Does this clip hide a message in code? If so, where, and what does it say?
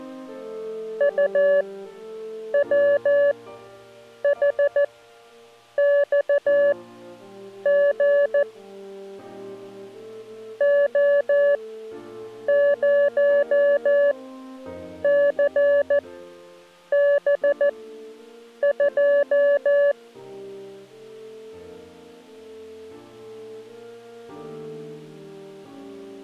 Yes: Morse code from 0.9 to 20.0 s, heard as a keyed tone, machine-sent, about 14 wpm, spaced as for 7 wpm, 570 Hz. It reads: UWHXG O0CB2